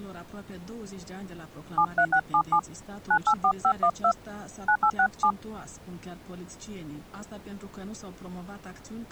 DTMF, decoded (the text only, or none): 73677 984512 9867